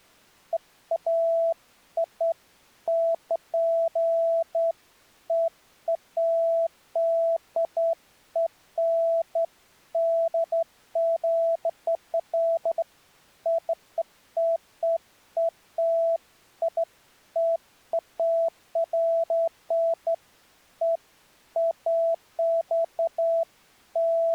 Beeps of irregular length. There is no code.